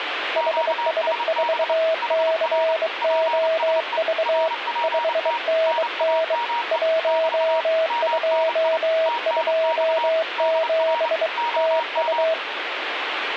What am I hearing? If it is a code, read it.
Morse code, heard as two keyed tones, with radio static. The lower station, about 23 wpm, 650 Hz: HS4COV 5NN 1227 TU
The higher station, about 29 wpm, 940 Hz: QSB HR PSE RPT NAME <BT> MNI TNX DR OM